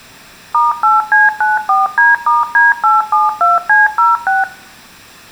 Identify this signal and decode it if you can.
DTMF, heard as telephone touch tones, dialled by machine, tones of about 170 ms, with room echo. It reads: *8C94D*D872C06